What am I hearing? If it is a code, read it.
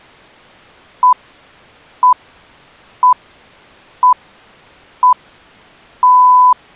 Radio time signal (six pips, as the Greenwich Time Signal), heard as pips.